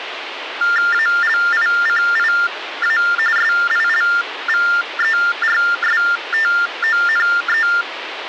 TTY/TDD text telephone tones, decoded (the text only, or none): ALICIA SILVERSTONE